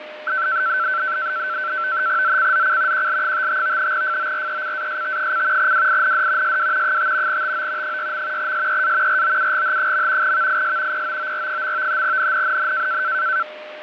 NAVTEX (SITOR-B), 100 baud, 170 Hz shift, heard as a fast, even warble, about 1440 Hz centre, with radio static, fading and a steady whistle near 610 Hz. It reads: ZCZC QL55 FORECAST: WIND SW 5 TO 6. SEA ROUGH. VIS POOR. NNNN